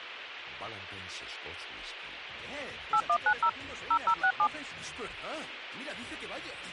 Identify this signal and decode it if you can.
DTMF, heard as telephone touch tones, dialled by machine, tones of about 70 ms. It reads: 8190 0067